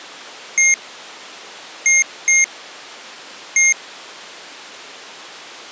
Beep code, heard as beeps from a small speaker, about 2150 Hz. 1-2-1. In Phoenix BIOS tables: interval timer failure.